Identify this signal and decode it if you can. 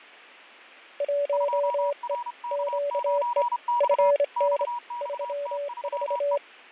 Morse code, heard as two keyed tones, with fading. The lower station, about 26 wpm, 570 Hz: 1E QE FN 34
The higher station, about 31 wpm, 960 Hz: 2RK9X XXT3E